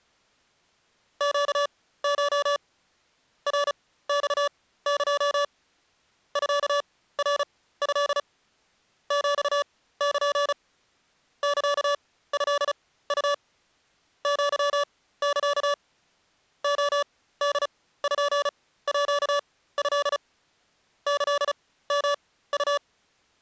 Morse code (Japanese Wabun code), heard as electronic beeps, machine-sent, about 35 wpm, spaced as for 17 wpm, 580 Hz. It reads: ネコ ナマエ ミナト ヒル サトウ アサ レポート キヨウ